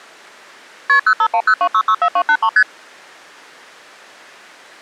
Multi-frequency trunk signalling (R1, as on North American trunks), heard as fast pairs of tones, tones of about 70 ms. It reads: KP 05102664283 ST